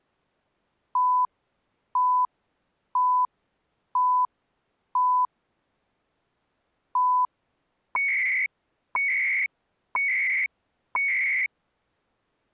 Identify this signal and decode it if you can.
Radio time signal (CHU, Canada), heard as beeps and data bursts, one a second.